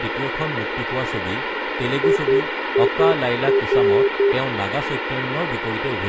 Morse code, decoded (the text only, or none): IIR